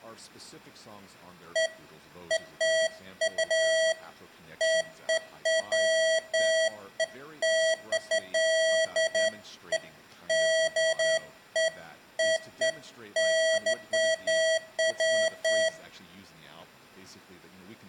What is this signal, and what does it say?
Beeps of irregular length, with room echo and speech in English. There is no code.